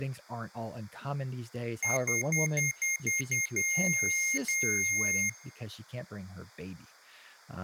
Beep code, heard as beeps from a small speaker, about 2150 Hz, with speech in English. 7 short, 2 long.